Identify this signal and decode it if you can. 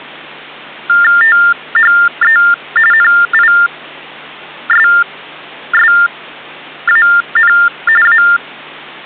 TTY/TDD text telephone tones (45.45 baud Baudot), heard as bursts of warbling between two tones, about 400 Hz shift, 1600 Hz centre, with hum. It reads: THE NISSAN A